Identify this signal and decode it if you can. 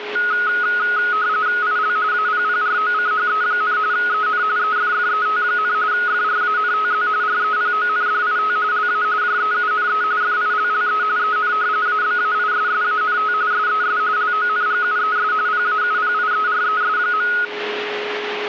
RTTY (45.45 baud, 170 Hz shift), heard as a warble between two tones, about 1360 Hz centre, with radio static and a steady whistle near 420 Hz. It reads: IL APPROCHE, EN EFFET, FRANTZ REPONDIT LA JEUNE FILLE EN ABAISSANT SES LONGUES PAUPIERES.